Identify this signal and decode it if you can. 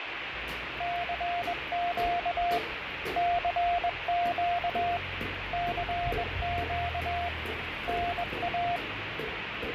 Morse code, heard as a keyed tone, hand-sent with a bug key, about 21 wpm, 700 Hz, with radio static and the noise of a residential street. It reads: CQ CQ CQ NA